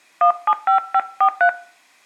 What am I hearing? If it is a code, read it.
DTMF, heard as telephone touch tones, dialled by hand, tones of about 80 ms. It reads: 175543